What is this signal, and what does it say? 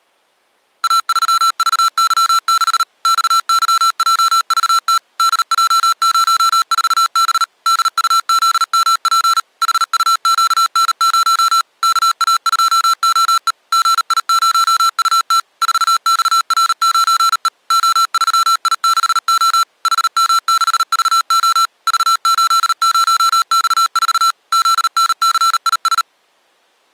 Morse code, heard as electronic beeps, machine-sent, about 38 wpm, 1340 Hz. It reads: A3VY6 XYJVT DJ04B DUZMP HUQN0 KA2OE GI0UT 4XR9E O3I6O HM6VO V80X4 ZNCIS